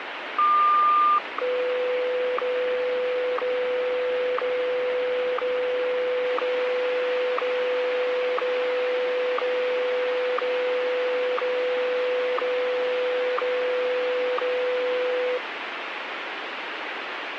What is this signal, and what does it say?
Radio time signal (WWVH, Hawaii), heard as ticks, one a second, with radio static.